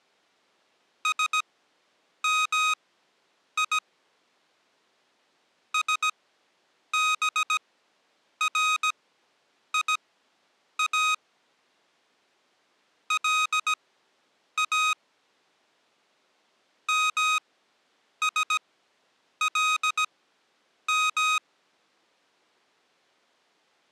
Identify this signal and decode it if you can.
Morse code (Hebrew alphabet), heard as electronic beeps, machine-sent, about 17 wpm, spaced as for 8 wpm, 1250 Hz. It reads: שמי שבריא לא משלם